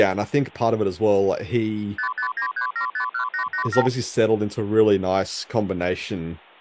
Multi-frequency trunk signalling (R2, with the far end's replies), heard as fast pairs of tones, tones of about 100 ms, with hum. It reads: 5593751887